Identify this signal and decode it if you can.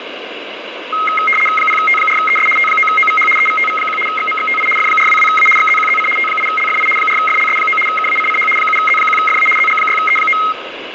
RTTY (75 baud, 850 Hz shift), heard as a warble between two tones, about 1700 Hz centre, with radio static. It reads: 0T4ES T9OVH EVTV1 XMXTI F422A XZQZC T8LFI 4FLS9 KACCH 7Z1FA ZG6E9